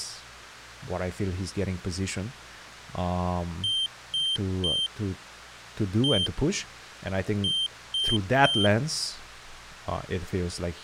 Beep code, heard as a piezo beeper, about 3150 Hz, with speech in English. 3-1-3. In Phoenix BIOS tables: interrupt mask register failure.